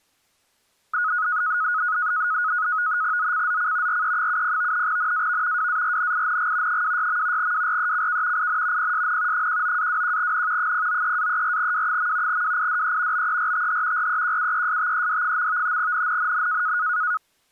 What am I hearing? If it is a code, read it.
NAVTEX (SITOR-B), 100 baud, 170 Hz shift, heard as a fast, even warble, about 1360 Hz centre. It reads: ZCZC RE70 NAV WARNING 26. WRECK IN PSN 19-21N 093-34W. WIDE BERTH REQUESTED. NNNN